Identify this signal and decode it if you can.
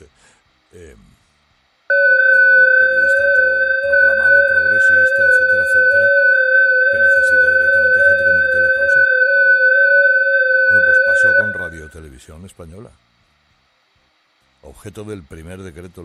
FT8 (several signals at once), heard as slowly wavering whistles, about 6.25 baud, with room echo.